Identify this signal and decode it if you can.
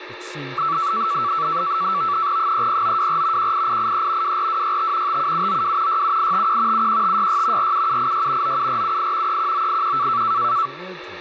NAVTEX (SITOR-B), 100 baud, 170 Hz shift, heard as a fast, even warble, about 1230 Hz centre, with radio static, a steady whistle near 360 Hz and speech in English. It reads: 30924 18883 24265 57792 67851 71566 47786 97478 31981